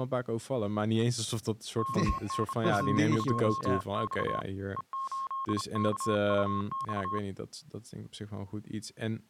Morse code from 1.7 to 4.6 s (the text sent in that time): KNU2X